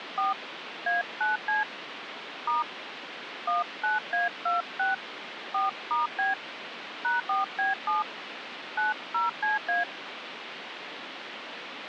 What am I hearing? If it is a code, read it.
DTMF, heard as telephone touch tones, dialled by hand, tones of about 150 ms, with phone line noise. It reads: 4 A9C * 19A26 4*B #4B7 90CA